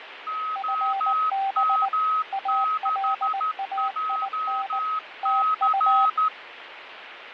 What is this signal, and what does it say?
Morse code, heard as two keyed tones, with radio static and fading. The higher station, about 13 wpm, 1270 Hz: OM6JC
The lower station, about 19 wpm, 780 Hz: FB ALAIN TU